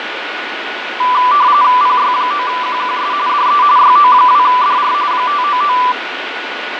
RTTY (45.45 baud, 170 Hz shift), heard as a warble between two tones, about 1080 Hz centre, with radio static, fading and a steady whistle near 1470 Hz. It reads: PY9QQS DE YO2DR 599